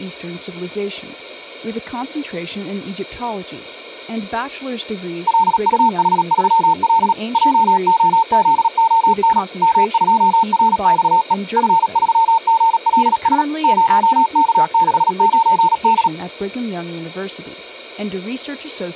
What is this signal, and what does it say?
Morse code, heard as a keyed tone, machine-sent, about 37 wpm, 900 Hz, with speech in English. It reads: LUH3L JOZON M2RXE F3GLS 0K69D